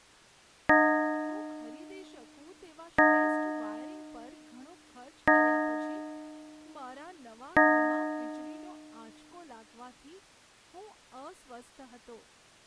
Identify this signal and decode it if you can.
Clock strike, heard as a bell, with speech in Gujarati. 4. Four o'clock.